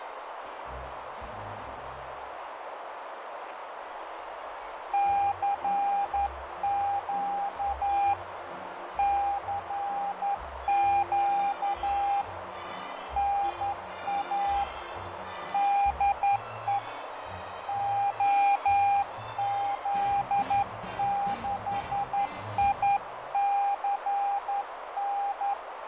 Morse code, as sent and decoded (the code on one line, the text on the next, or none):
-.-. --.- / -.-. --.- / -. .- / -.. . / --- --.. -.... .. -.-. -.
CQ CQ NA DE OZ6ICN